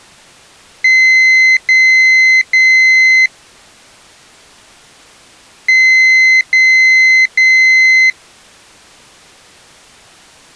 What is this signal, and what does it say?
Beep code, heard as a piezo beeper, played twice, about 2050 Hz. 3 long. In IBM BIOS tables: keyboard card error.